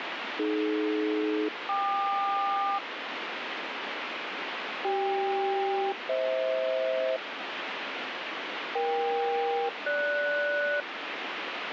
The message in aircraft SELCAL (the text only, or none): AD-KQ CK-FH EK-GS